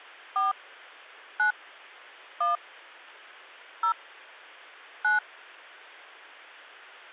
DTMF, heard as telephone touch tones, dialled by hand, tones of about 160 ms. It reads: 4 9 1 0 9